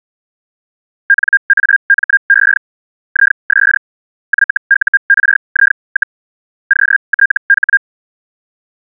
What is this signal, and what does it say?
Hellschreiber (Feld-Hell, 122.5 baud), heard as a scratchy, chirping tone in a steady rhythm, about 1600 Hz. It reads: NAME IS YURI, QTH